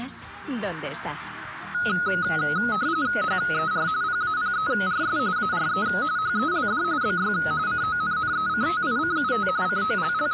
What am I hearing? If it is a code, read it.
RTTY (45.45 baud, 170 Hz shift), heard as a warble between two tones, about 1360 Hz centre. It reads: HER PAPERS ARE HELD BY CONNECTICUT …